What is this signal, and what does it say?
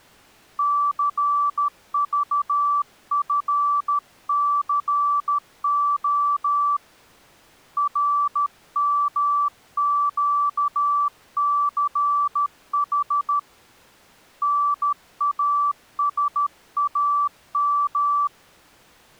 Morse code, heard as a keyed tone, hand-sent with a paddle, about 13 wpm, 1160 Hz. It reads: CVFCO RMQCH NASAM